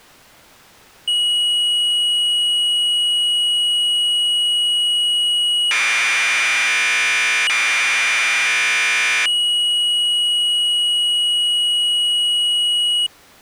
Commodore tape loading (standard loader), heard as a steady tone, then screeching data.